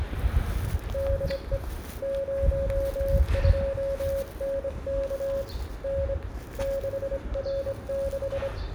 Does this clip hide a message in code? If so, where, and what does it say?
Yes: Morse code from 0.9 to 8.5 s, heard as a keyed tone, hand-sent with a straight key, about 25 wpm, 550 Hz, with radio static, room echo and the noise of a residential street. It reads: DE 02NK N 6R6